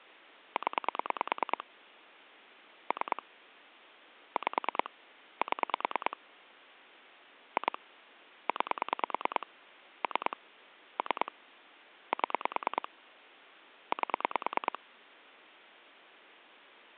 Pulse dialling, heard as clicks on a phone line, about 9 pulses a second. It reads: 0 3 5 7 2 9 3 3 7 8